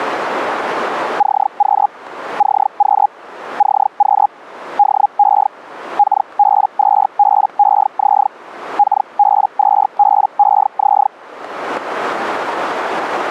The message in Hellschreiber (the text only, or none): CQ CQ CQ DE KB2BEZ KB2BEZ